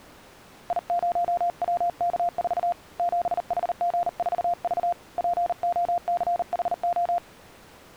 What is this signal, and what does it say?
Morse code, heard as a keyed tone, hand-sent with a paddle, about 39 wpm, 700 Hz. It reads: I0WK4 7HG4V POCHO